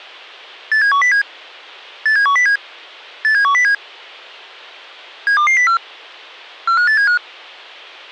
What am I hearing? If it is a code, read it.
Five-tone selective call (CCIR), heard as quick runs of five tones, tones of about 100 ms. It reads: 87107 87107 87107 72204 45875